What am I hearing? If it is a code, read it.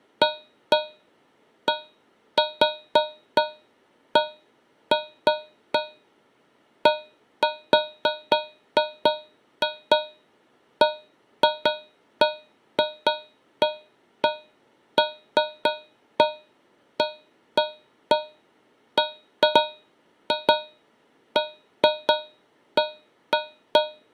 Irregular taps on a metal pipe. There is no code.